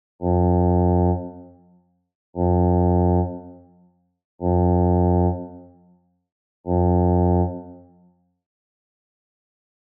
Ship horn signal, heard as a ship's horn, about 90 Hz, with room echo. 4 short. At sea: a pilot vessel's identity signal in fog.